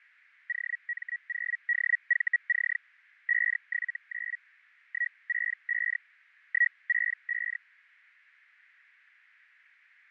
Hellschreiber (Feld-Hell, 122.5 baud), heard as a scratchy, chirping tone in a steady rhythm, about 1900 Hz, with fading. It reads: OM0DVC 579 165 165